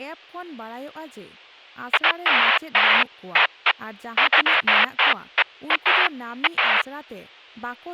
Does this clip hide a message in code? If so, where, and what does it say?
No, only bursts of noise, with speech in Santali.